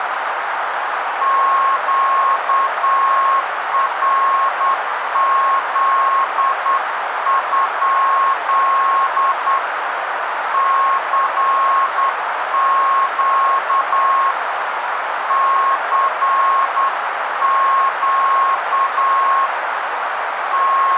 Morse code, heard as a keyed tone, hand-sent with a straight key, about 9 wpm, 1080 Hz, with radio static and a narrow filter. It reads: QRZ? CQ CQ …